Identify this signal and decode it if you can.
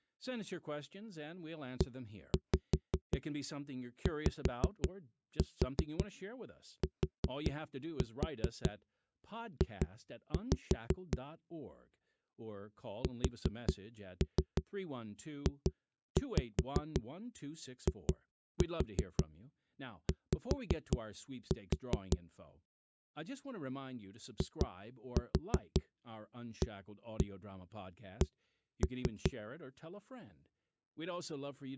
Tap code, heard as knocks on a wall, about 5 knocks a second, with speech in English. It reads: EYTJ SJIY IAC